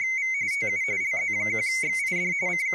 RTTY (45.45 baud, 170 Hz shift), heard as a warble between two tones, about 2150 Hz centre, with speech in English. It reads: … TU LZ1XID …